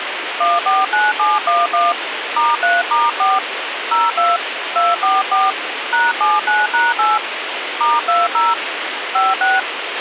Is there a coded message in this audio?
Yes: DTMF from 0.4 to 9.6 s, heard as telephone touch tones, dialled by hand, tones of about 190 ms, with radio hiss and a squelch burst at the end. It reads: 149711 *3*4 02 244 #79#8 *20 56